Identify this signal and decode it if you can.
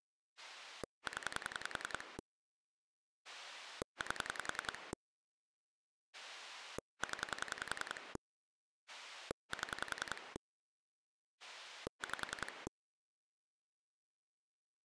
Pulse dialling, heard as a rotary dial, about 10 pulses a second. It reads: 0 8 0 7 5